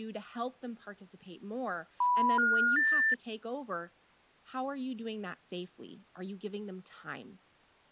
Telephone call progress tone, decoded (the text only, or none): special information tone